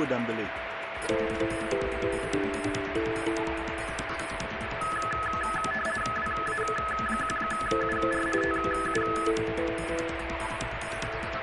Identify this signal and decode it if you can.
RTTY (50 baud, 450 Hz shift), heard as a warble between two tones, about 1500 Hz centre, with radio static and a steady whistle near 660 Hz. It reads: WA1UR TU